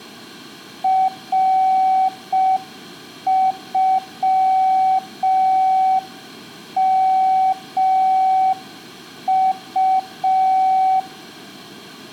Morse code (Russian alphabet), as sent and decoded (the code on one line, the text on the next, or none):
.-. ..-- -- ..-
РЮМУ